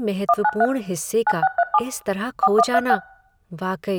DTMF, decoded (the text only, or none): 193 9637 4136